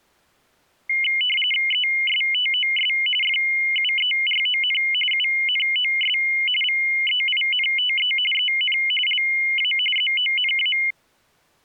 RTTY (45.45 baud, 850 Hz shift), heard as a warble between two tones, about 2550 Hz centre. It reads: ESTOS FUERON UNOS VEINTE EN LA ZONA